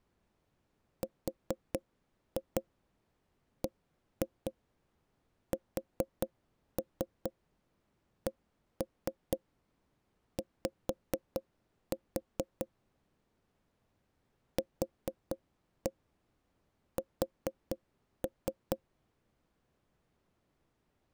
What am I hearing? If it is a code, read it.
Tap code, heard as knocks on wood, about 4 knocks a second. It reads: RBSCY QS